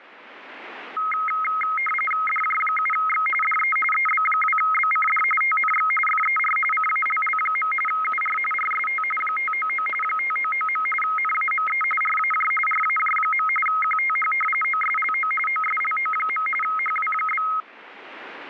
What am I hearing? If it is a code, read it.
RTTY (45.45 baud, 850 Hz shift), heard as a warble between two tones, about 1700 Hz centre, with static crashes. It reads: DJ7X DE EB2BCD TNX FER CALL. UR RST 599 599. NAME RAJ RAJ. QTH OSLO OSLO. HW?